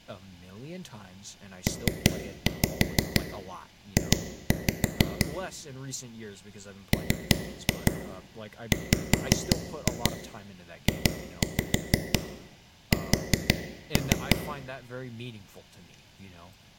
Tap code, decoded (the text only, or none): PJ MWJS